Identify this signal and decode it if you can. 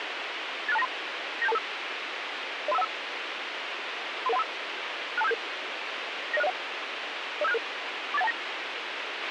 Five-tone selective call (EIA), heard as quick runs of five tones, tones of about 30 ms, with radio hiss and a squelch burst at the end. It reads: 86293 97225 03515 33135 62577 90601 05766 48129